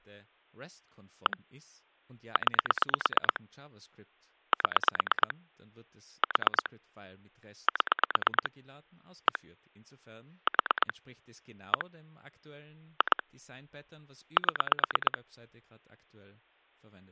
Pulse dialling, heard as clicks on a phone line, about 9 pulses a second, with speech in German. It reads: 1 9 7 4 7 1 4 1 2 7